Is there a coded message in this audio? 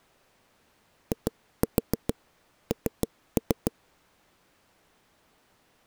Yes: tap code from 1.1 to 3.7 s, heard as knocks on a wall, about 6 knocks a second. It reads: IN